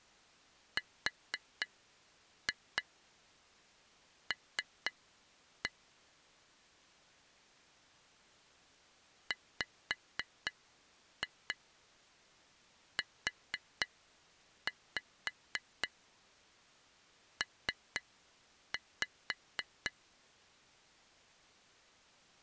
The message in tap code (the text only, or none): RL WUP